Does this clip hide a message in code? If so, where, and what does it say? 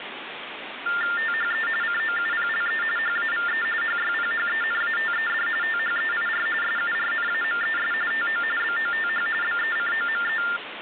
Yes: TTY/TDD text telephone tones (45.45 baud Baudot) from 0.9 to 10.6 s, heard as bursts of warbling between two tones, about 400 Hz shift, 1600 Hz centre, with phone line noise. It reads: THE COUPLE HAVE HYPHENATED THEIR SURNAMES TO BOTH BECOME